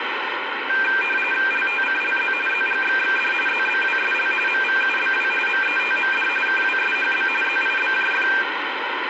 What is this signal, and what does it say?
RTTY (45.45 baud, 850 Hz shift), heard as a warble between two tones, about 2000 Hz centre, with radio static. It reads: LTCLZ ZGXXD ZBWSL MVUBW METMD KWSHB ZIBJF